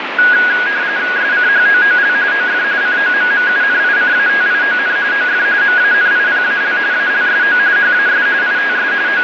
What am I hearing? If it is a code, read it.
RTTY (45.45 baud, 170 Hz shift), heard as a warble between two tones, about 1550 Hz centre, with radio static and fading. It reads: SCHOOL OF COMMUNICATION OF MANIPAL ALSO HAS ITS …